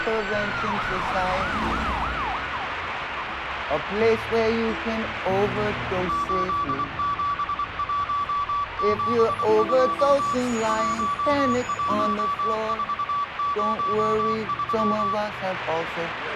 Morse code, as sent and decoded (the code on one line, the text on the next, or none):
---.. --... .---- --... ..--- / .---- .---- ....- ----- ...--
87172 11403